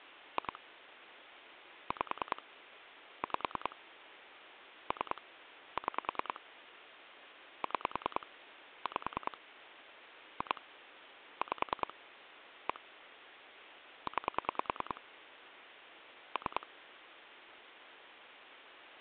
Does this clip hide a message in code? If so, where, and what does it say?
Yes: pulse dialling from 0.4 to 16.6 s, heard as clicks on a phone line, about 10 pulses a second. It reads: 2 5 5 3 6 6 5 2 5 1 9 3